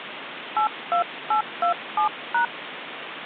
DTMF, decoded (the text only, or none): 82827#